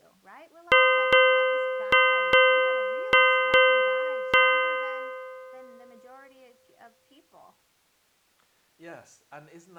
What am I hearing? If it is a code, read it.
Ship's bell, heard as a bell, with speech in English. 7. Seven half-hours of the watch have passed.